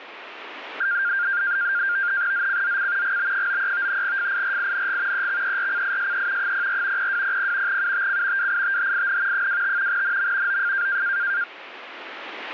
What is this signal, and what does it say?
NAVTEX (SITOR-B), 100 baud, 170 Hz shift, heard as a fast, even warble, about 1500 Hz centre, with radio static. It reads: ZCZC GB93 FIRING EXERCISE 04 0200 UTC WITHIN 25 NM OF